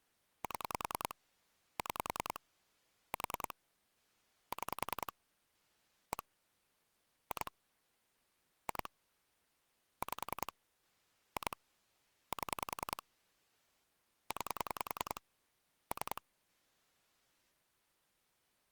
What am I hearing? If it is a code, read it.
Pulse dialling, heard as clicks on a phone line, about 10 pulses a second. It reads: 7 6 4 6 1 2 2 5 2 7 9 3